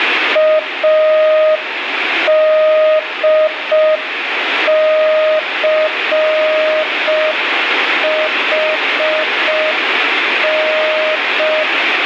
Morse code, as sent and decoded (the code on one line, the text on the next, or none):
.- -.. -.-. .... -.
ADCHN